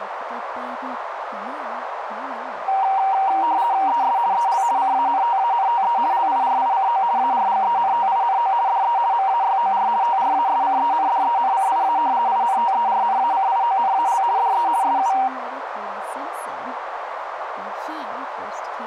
RTTY (50 baud, 170 Hz shift), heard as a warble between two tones, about 860 Hz centre, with radio static, a narrow filter and speech in English. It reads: ES EL CANTANTE LIRICO ARGENTINO DE MAYOR TRASCENDENCIA INTERNACIONAL DE SU